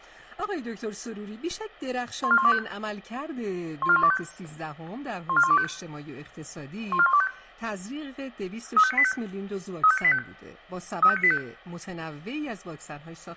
Five-tone selective call (ZVEI), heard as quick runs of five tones, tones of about 70 ms, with room echo. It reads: 14125 14125 14125 14125 35985 35985 35985